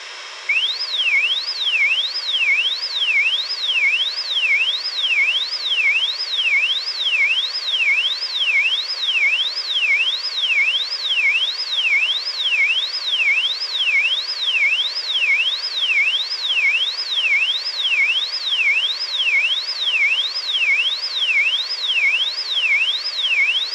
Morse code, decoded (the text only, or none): none